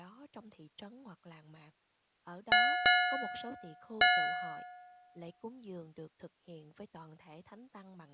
Ship's bell, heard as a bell, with speech in Vietnamese. 3. Three half-hours of the watch have passed.